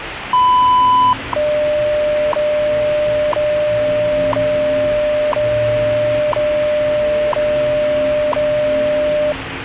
Radio time signal (WWV, Colorado), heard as ticks, one a second, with radio static and the noise inside a lift.